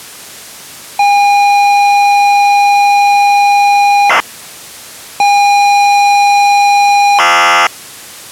ZX Spectrum tape loading, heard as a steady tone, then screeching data.